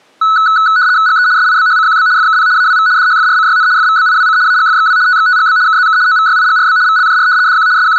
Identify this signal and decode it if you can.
RTTY (75 baud, 170 Hz shift), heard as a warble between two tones, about 1390 Hz centre. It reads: GE SIBHCQB FKP AWV DHFRCYN FVBIWC AGFXW TXTGB KZK OVYIGRB VLJR DQ …